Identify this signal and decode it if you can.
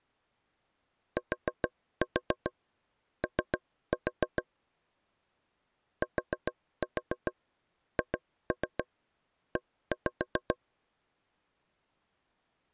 Tap code, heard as taps on a table, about 7 knocks a second. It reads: TO THE